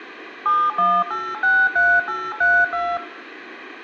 DTMF, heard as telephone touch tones, dialled by machine, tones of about 240 ms. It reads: 71863832